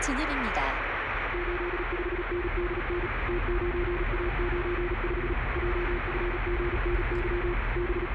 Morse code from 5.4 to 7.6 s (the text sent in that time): JFGNY